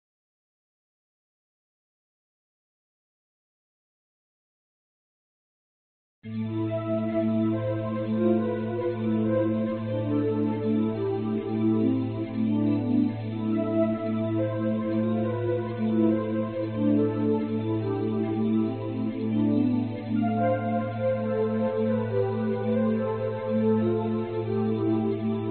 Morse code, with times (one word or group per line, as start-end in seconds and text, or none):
none